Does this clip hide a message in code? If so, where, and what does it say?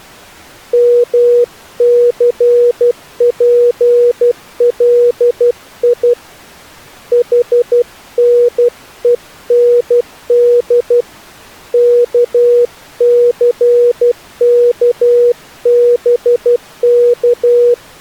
Yes: Morse code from 0.7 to 17.8 s, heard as a keyed tone, hand-sent with a paddle, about 12 wpm, 480 Hz. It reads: MCPLI HNEND KCKBK